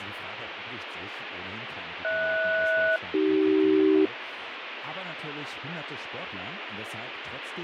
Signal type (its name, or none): aircraft SELCAL